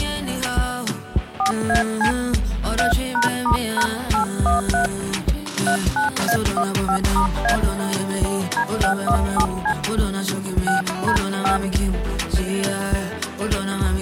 DTMF, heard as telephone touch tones, dialled by hand, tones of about 110 ms. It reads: 4AC 3#*#813 39A15*A D617C 6D5